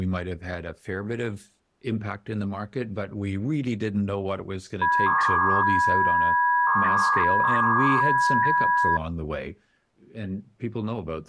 300-baud modem data (V.21 tones), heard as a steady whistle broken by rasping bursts, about 300 baud, 200 Hz shift, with speech in English.